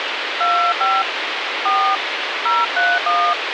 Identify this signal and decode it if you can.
DTMF, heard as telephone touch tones, dialled by hand, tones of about 240 ms, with radio hiss. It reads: 25 4 031